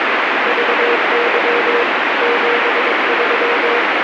Morse code, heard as a keyed tone, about 22 wpm, 480 Hz, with heavy radio static. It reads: VY 73